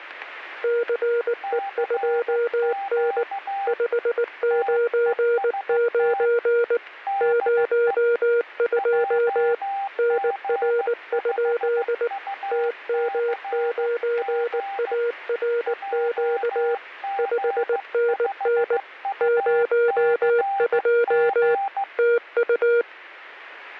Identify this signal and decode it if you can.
Morse code, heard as two keyed tones. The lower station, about 19 wpm, 470 Hz: CE2N 599 02 NR? TM9ARQ 5NN 02 TU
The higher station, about 15 wpm, 790 Hz: CQ TEST DE JG5UCG JG5UCG